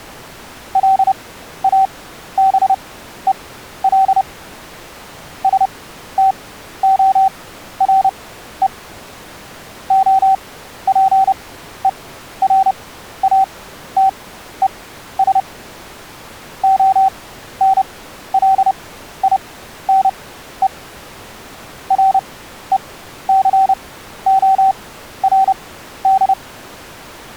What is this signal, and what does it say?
Morse code, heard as a keyed tone, machine-sent, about 30 wpm, spaced as for 13 wpm, 770 Hz. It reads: LABEL STORE OPERATES ONLINE RECORD